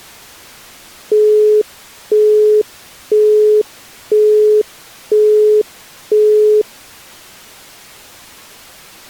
Telephone call progress tone (single-tone plan, as in Europe, Japan and elsewhere), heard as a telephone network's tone, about 420 Hz, 0.5 s on and 0.5 s off. Busy tone.